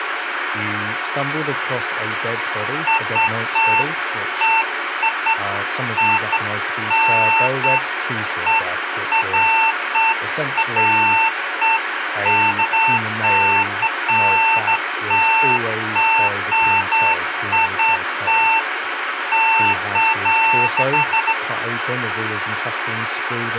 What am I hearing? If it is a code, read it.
Beeps of irregular length, with radio hiss and speech in English. There is no code.